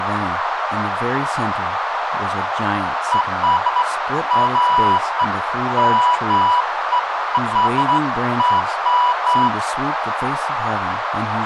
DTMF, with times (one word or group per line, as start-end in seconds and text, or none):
none